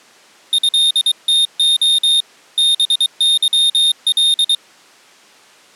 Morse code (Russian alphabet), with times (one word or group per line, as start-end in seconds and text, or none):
0.5-2.2 ЭТО
2.6-4.5 БЫЛ